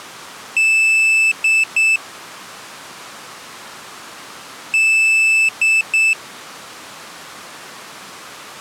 Beep code, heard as a piezo beeper, played twice, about 2650 Hz. 1 long, 2 short. In Award, IBM and AMI BIOS tables: video adapter failure.